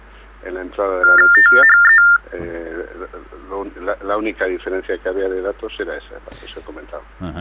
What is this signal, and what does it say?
TTY/TDD text telephone tones (45.45 baud Baudot), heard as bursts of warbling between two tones, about 400 Hz shift, 1600 Hz centre. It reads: THE